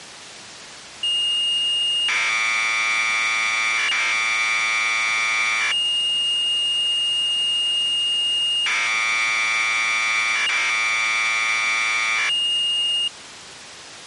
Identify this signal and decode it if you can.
Commodore tape loading (standard loader), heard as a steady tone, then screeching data.